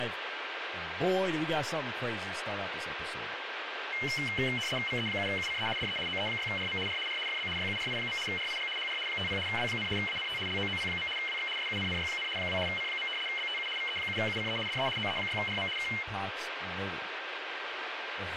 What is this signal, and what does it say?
RTTY (75 baud, 850 Hz shift), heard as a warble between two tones, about 2550 Hz centre, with radio static and speech in English. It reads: VE7UCE DE OE6RM R R FB YURI. RIG HR 50 W, ANT LOOP. WX SUNNY, 2 C. BTU VE7UCE DE OE6RM K